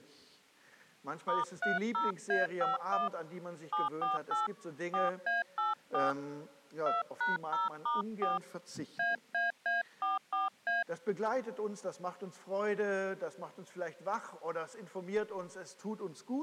DTMF, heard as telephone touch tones, dialled by hand, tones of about 160 ms. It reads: *30A51 748 4A84 2#0*4 AAA44A